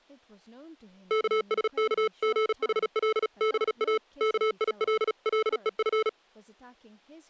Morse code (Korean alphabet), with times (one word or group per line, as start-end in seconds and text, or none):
1.1-4.0 영숙도
4.2-6.1 약간